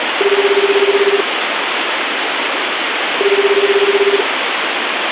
Telephone call progress tone (Japanese plan), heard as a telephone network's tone, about 380, 400, 420 Hz, 1 s on and 2 s off, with phone line noise. Ringback tone.